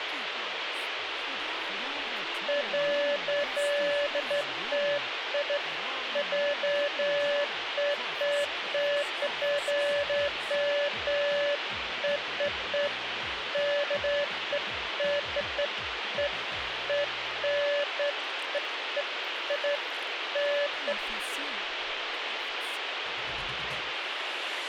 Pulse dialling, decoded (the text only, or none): none